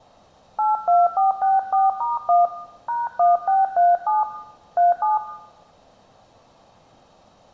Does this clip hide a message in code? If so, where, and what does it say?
Yes: DTMF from 0.6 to 5.2 s, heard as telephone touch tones, dialled by hand, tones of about 170 ms, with room echo. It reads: 82464*1 #1637 37